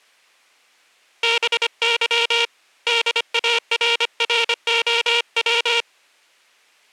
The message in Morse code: BY DARROW

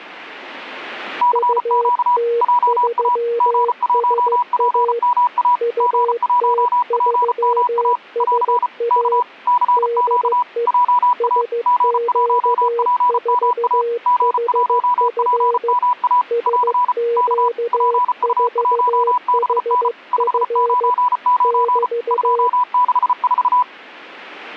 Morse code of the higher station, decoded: CQ JA G1PMA G1PMA <AR> K CQ JA G1PMA G1PMA <AR> K PU1BN 599 264

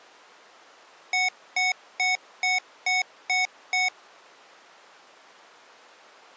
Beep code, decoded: 7 short

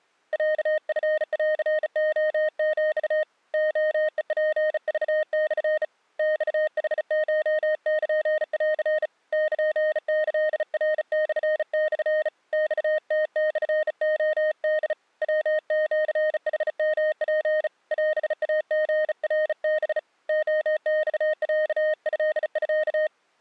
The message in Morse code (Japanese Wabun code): ロチンレヒ レヘツクモ マヌコルン ルキナモモ マムモレホ ヤシヌヨツ オイリナハ レマロトミ

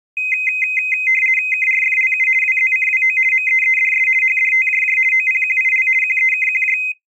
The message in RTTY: KRFLU WZCWO MEEDS HDTJJ OPQIL QEKQJ

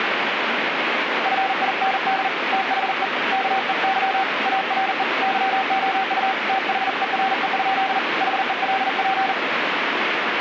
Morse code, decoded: FIND THE KEY ARE YOU THERE? HELP

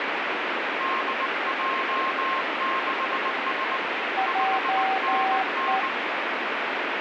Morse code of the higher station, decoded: DJ6S 5NN

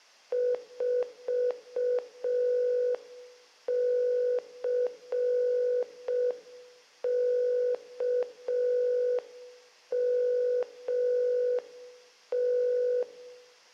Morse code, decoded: 4CKMT

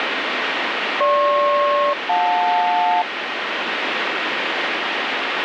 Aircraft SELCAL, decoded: GP-JL

